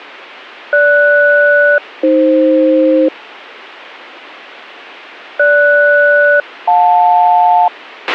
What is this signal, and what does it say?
Aircraft SELCAL, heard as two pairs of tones, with a squelch burst at the end. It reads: GS-AF GS-JL